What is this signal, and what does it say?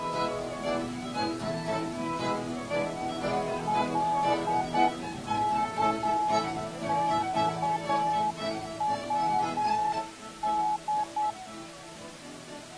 Morse code, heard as a keyed tone, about 9 wpm, 850 Hz. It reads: LKXWD